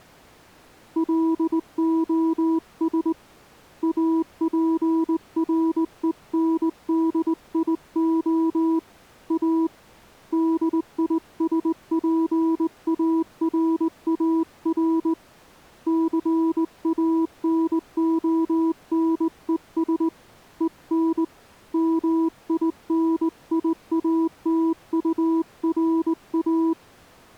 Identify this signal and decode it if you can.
Morse code, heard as a keyed tone, hand-sent with a straight key, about 19 wpm, 330 Hz. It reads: LOS APRENDIO A DISPARAR CANONES EN MINIATURA